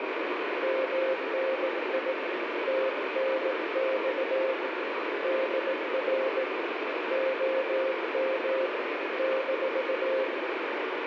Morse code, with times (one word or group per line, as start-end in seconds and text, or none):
0.6-2.1 MNI
2.7-4.5 TNX
5.2-6.4 DR
7.1-8.7 OM
9.2-10.2 -